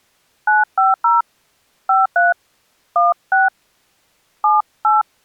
DTMF, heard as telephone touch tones, dialled by hand, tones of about 170 ms. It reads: 950 53 16 78